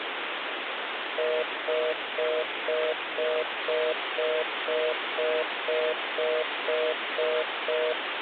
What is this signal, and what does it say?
Telephone call progress tone (North American plan), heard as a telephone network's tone, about 480, 620 Hz, 0.25 s on and 0.25 s off, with phone line noise. Congestion tone.